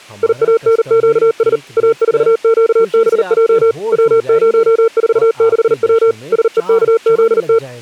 Morse code, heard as a keyed tone, machine-sent, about 39 wpm, 450 Hz, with speech in Hindi. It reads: IANQS A4QBJ W046W SEKZT